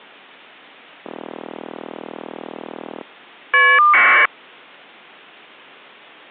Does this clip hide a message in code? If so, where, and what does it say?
Yes: caller ID data burst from 1.0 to 4.3 s, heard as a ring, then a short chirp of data, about 1200 baud.